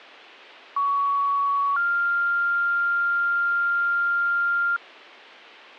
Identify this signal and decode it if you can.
Two-tone page, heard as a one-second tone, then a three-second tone, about 1120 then 1400 Hz.